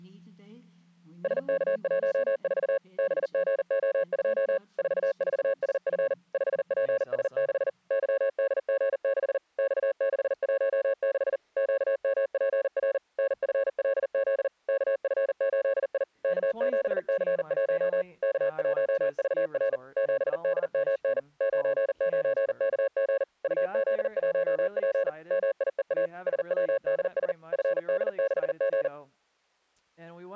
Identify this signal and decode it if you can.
Morse code, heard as a keyed tone, machine-sent, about 40 wpm, 550 Hz. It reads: SK14 BGO2 44SF 5PS6 YDG6 X616 QMPR NFLZ KF8I K7C1 K1VR 7DMN 99KG UZ1P MIEA SWDS FD6G